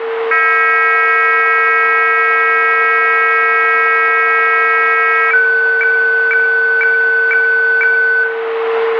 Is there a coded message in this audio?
Yes: weather fax (radiofax), 120 lines a minute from 0.3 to 8.2 s, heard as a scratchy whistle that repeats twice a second, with radio static, a steady whistle near 450 Hz and room echo.